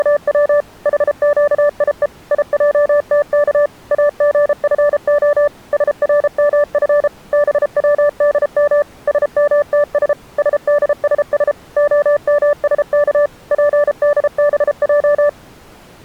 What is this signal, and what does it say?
Morse code, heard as a keyed tone, machine-sent, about 33 wpm, 580 Hz. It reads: … HQIE IJTK AGFO SRMF BWDM SMTS SDSS OMSK PDBJ